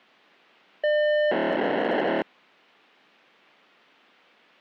POCSAG pager data (1200 baud), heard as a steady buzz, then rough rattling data.